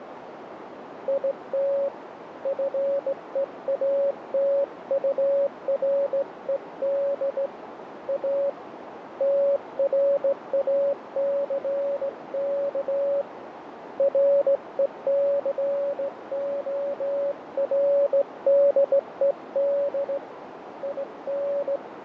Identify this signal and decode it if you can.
Morse code, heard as a keyed tone, hand-sent with a straight key, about 17 wpm, 560 Hz, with radio static, fading and a narrow filter. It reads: IT FEATURED A TRACK RECORDED IN